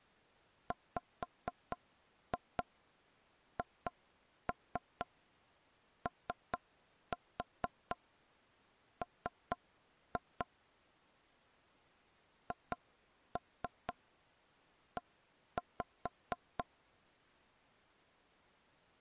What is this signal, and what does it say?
Tap code, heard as taps on a table, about 4 knocks a second. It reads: WHOM HE